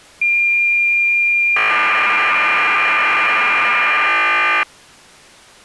Cassette data (Kansas City type), 1200 baud, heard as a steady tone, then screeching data.